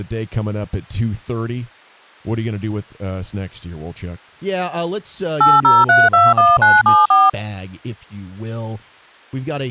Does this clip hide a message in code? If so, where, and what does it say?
Yes: DTMF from 5.4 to 7.3 s, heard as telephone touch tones, dialled by machine, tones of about 200 ms, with speech in English. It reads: 80321974